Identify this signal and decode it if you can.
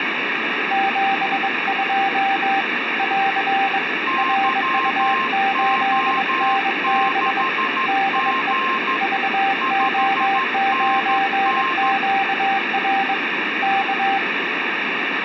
Morse code, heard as two keyed tones, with radio static. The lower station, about 22 wpm, 780 Hz: 72 <AR> RU8NB DE VO9QR K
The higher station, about 13 wpm, 1060 Hz: YO6G 5NN